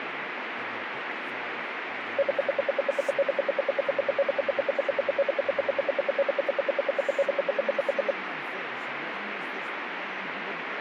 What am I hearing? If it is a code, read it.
Radio time signal (RWM, Moscow), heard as ten pulses a second, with radio static and speech in English.